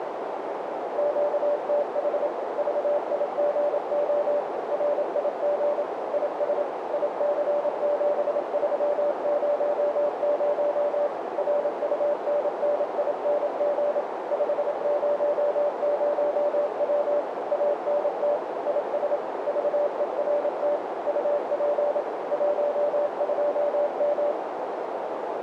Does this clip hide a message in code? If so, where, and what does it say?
Yes: Morse code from 0.9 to 24.4 s, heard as a keyed tone, machine-sent, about 27 wpm, 580 Hz, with heavy radio static and a narrow filter. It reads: QTH VIGO RIG IS IC7300 RUNNING 500W ANT IS VERT UP 12M